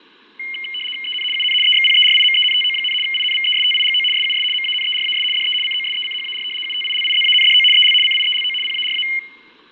RTTY (75 baud, 850 Hz shift), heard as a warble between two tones, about 2550 Hz centre, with fading. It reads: EN UN EXPERIMENTO, INVESTIGO SUS MANERAS DE COSECHAR UTILIZANDO EL CIELO PARA